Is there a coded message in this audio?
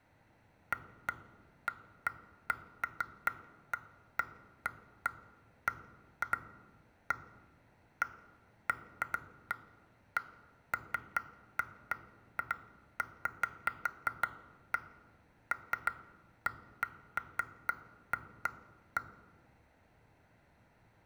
No, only irregular taps on glass, with room echo.